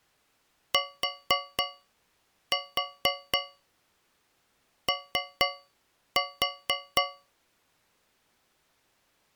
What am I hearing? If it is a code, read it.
Tap code, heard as taps on a metal pipe, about 4 knocks a second. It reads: TO